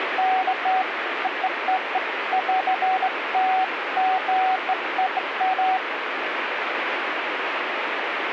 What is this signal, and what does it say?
Beeps of irregular length, with radio static. There is no code.